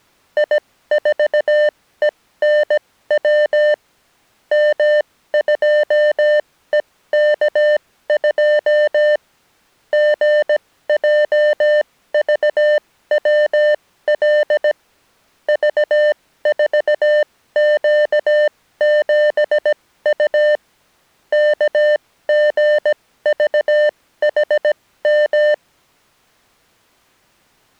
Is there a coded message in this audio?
Yes: Morse code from 0.3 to 25.6 s, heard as electronic beeps, machine-sent, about 17 wpm, spaced as for 14 wpm, 600 Hz. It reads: I4ENW M2EK2 GJVWL V4Q7U KGVHM